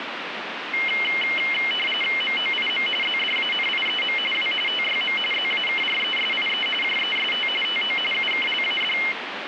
RTTY (45.45 baud, 850 Hz shift), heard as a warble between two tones, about 2550 Hz centre, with radio static. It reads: MOIM ZDANIEM W TYM ZAKRESIE JEST TO UKLAD